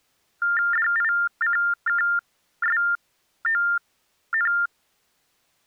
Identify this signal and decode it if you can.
TTY/TDD text telephone tones (45.45 baud Baudot), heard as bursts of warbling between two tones, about 400 Hz shift, 1600 Hz centre. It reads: DICKSON